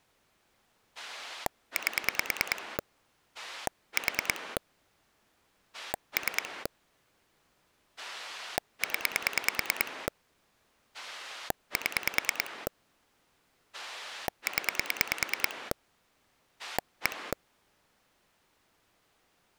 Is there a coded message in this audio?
Yes: pulse dialling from 1.0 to 17.3 s, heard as a rotary dial, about 9 pulses a second. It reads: 8 4 3 0 7 0 1